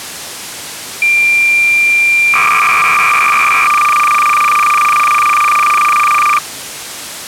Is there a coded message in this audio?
Yes: cassette data (Kansas City type), 300 baud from 1.0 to 6.4 s, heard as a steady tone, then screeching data.